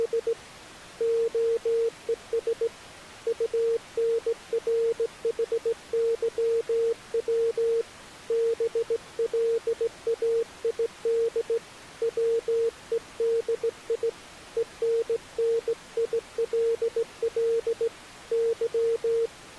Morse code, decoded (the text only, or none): … OES UNRHYW BLAID WEDI ENNILL Y